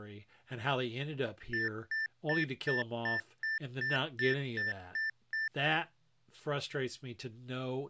Beep code, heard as beeps, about 1800 Hz, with speech in English. 11 short. In AMI BIOS tables: cache memory error.